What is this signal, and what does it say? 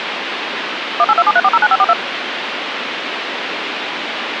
DTMF, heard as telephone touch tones, dialled by machine, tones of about 50 ms, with phone line noise. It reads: 18273409542